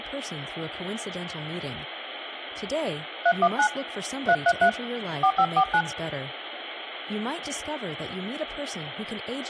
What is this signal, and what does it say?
DTMF, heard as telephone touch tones, dialled by hand, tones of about 70 ms, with phone line noise and speech in English. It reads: 319 333 4549